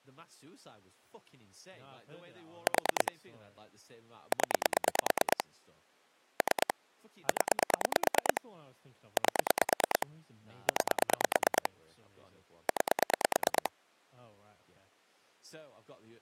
Pulse dialling, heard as clicks on a phone line, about 9 pulses a second, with speech in English. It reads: 4 0 3 0 8 9 9